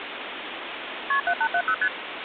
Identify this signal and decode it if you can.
Multi-frequency trunk signalling (R1, as on North American trunks), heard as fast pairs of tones, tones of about 70 ms, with phone line noise. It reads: KP 7870 ST